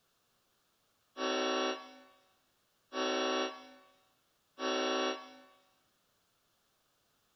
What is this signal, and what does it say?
Train horn signal, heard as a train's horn, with room echo. 3 short. On North American railways: when stopped, the train will back up.